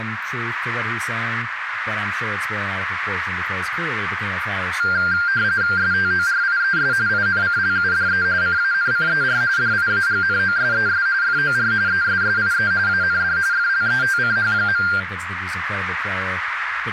RTTY (45.45 baud, 170 Hz shift), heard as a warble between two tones, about 1490 Hz centre, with radio static, a narrow filter and speech in English. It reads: STORIES INCLUDE CANCER DIAGNOSES FOR ESSIE AND FLETCH.